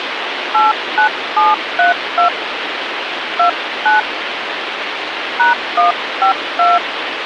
DTMF, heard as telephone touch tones, dialled by hand, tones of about 150 ms, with phone line noise. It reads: 89732 29 #152